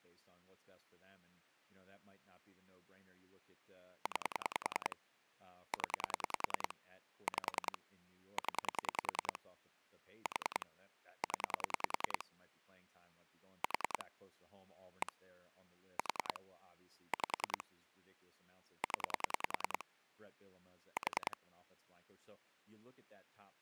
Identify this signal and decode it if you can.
Pulse dialling, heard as clicks on a phone line, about 10 pulses a second, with speech in English. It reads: 9 0 5 0 4 0 4 1 4 5 0 4